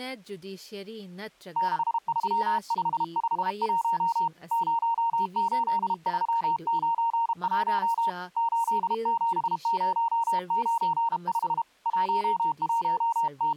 Morse code, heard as a keyed tone, hand-sent with a paddle, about 32 wpm, 920 Hz, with speech in Manipuri. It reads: 63551 08391 87095 …